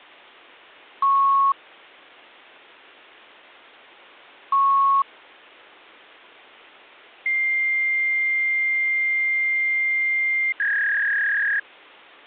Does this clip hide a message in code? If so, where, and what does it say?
Yes: fax machine handshake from 1.0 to 11.6 s, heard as beeps, a long tone and a warble.